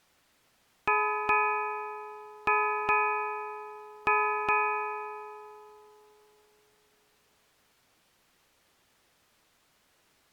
Ship's bell, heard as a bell. 6. Six half-hours of the watch have passed.